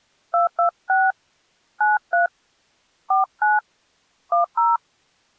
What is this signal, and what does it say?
DTMF, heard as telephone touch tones, dialled by hand, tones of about 160 ms. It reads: 226 93 49 10